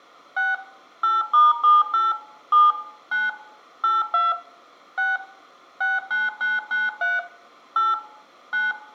DTMF, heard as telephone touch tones, dialled by machine, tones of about 180 ms, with room echo. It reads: 6 8*78 7 9 82 6 69993 8 9